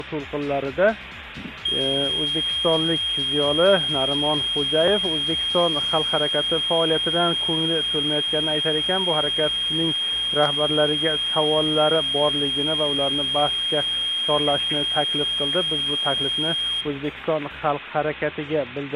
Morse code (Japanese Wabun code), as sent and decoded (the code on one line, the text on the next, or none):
none